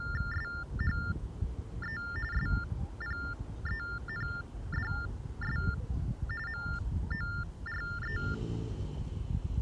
TTY/TDD text telephone tones (45.45 baud Baudot), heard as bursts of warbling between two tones, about 400 Hz shift, 1600 Hz centre, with the noise of a residential street. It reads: SHE SPENDS MORE